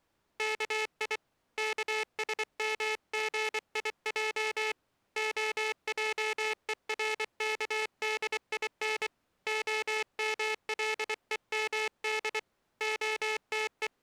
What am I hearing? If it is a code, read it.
Morse code (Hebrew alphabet), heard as a buzzer, hand-sent with a paddle, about 24 wpm. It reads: כי כשמגיע העורךדין המלומד …